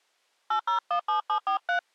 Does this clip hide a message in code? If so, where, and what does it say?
Yes: DTMF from 0.5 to 1.8 s, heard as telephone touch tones, dialled by hand, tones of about 100 ms. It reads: 8017743